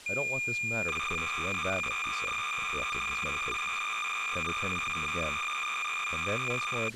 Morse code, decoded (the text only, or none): none